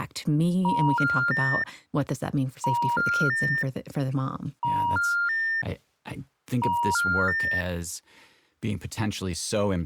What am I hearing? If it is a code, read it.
Telephone call progress tone (ITU plan), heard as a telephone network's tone, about 950, 1400, 1800 Hz, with speech in English. Special information tone.